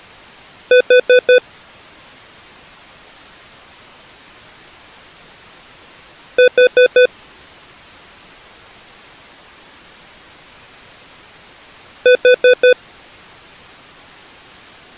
Alarm pattern, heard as an alarm's beeps, played three times, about 500 Hz. Temporal four. Carbon monoxide.